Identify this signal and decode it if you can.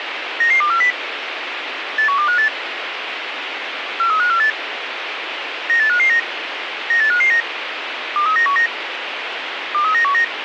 Five-tone selective call (CCIR), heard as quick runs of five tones, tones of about 100 ms, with radio hiss. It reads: 99240 81258 43548 98559 98559 23919 23919